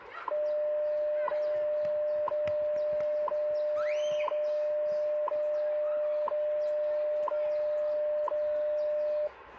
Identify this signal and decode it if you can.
Radio time signal (WWV, Colorado), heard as ticks, one a second, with radio static and the noise of a park.